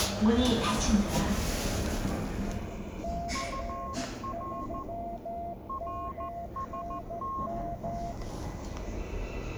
Morse code, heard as two keyed tones, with the noise inside a lift. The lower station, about 13 wpm, 690 Hz: C3MNM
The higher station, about 14 wpm, 1080 Hz: UR RST